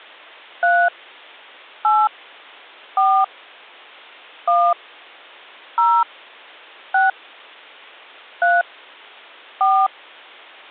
DTMF, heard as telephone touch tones, dialled by hand, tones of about 230 ms. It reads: 3 8 4 1 0 6 3 4